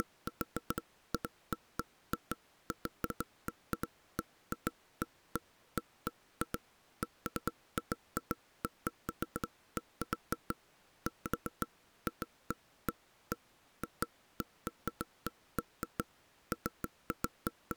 Irregular knocks on wood. There is no code.